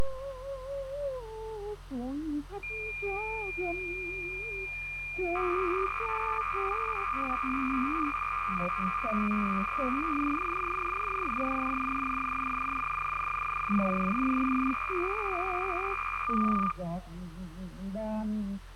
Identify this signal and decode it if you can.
Cassette data (Kansas City type), 300 baud, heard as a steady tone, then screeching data.